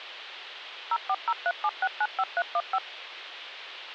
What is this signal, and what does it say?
DTMF, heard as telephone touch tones, dialled by machine, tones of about 50 ms, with radio hiss. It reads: 04037695315